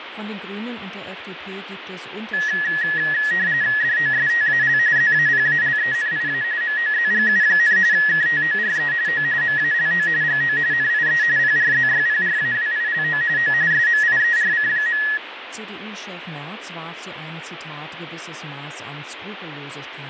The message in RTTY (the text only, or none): DOSTAL ZAPALENIA MOZGU, KTORE O MALO GO NIE PRZYPRAWILO O SMIERC.